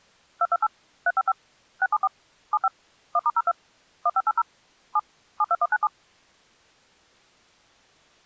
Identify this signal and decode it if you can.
DTMF, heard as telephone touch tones, dialled by machine, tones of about 40 ms. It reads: 228 355 674 75 1*02 1580 7 72197